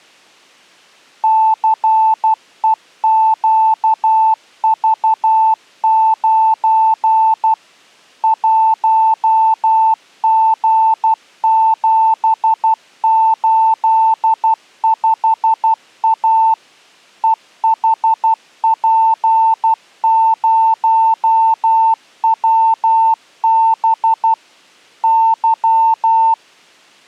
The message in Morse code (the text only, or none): CEQV9 1G785A EHP0WB Y